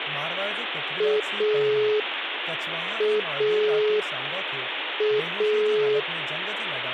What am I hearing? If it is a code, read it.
Telephone call progress tone (pulsed, as in Italy), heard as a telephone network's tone, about 420 Hz, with phone line noise and speech in Sindhi. Dial tone.